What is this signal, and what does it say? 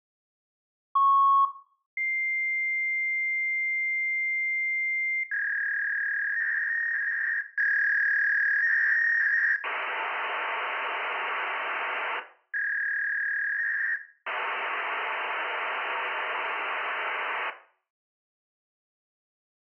Fax machine handshake, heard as a beep, a long tone, a warble and hiss, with room echo.